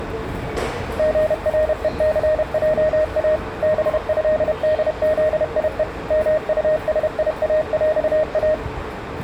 Morse code (with Polish letters), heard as a keyed tone, machine-sent, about 31 wpm, 620 Hz, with the noise of a subway station. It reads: GRECJA BĘDZIE MUSIAŁA